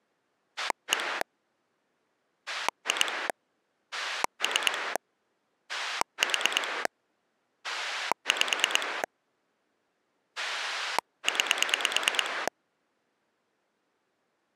Pulse dialling, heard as a rotary dial, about 9 pulses a second. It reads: 1 2 3 4 5 9